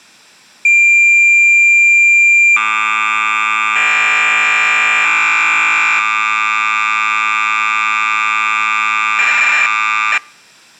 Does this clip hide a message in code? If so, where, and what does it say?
Yes: cassette data (Kansas City type), 1200 baud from 0.6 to 10.2 s, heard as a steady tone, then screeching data.